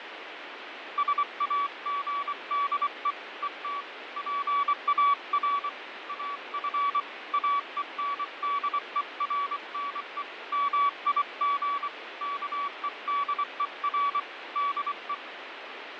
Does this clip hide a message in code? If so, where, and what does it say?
Yes: Morse code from 0.9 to 15.2 s, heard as a keyed tone, hand-sent with a paddle, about 24 wpm, 1140 Hz, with radio static and fading. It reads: SAGDE ET PAR AF AENDERNE MIG KEDER DE